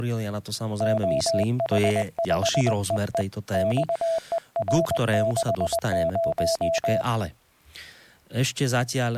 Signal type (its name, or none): Morse code